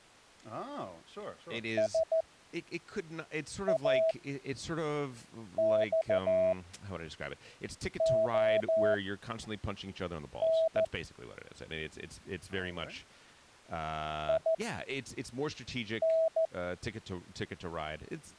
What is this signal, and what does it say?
Morse code, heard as a keyed tone, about 14 wpm, spaced as for 5 wpm, 650 Hz, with speech in English. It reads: SAXON IN